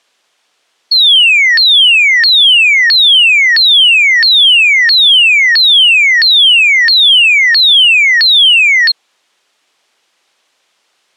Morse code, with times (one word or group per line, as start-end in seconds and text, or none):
none